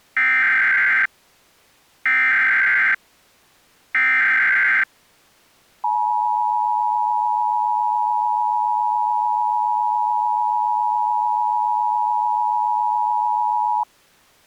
Emergency Alert System (SAME) tones (header bursts, then the 853 and 960 Hz attention tone), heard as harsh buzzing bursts, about 520.83 baud.